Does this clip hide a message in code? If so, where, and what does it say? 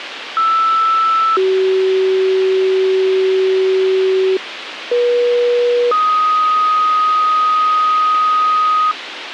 Yes: two-tone page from 0.4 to 8.9 s, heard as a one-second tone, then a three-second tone, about 1320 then 380 Hz, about 480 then 1250 Hz, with radio hiss.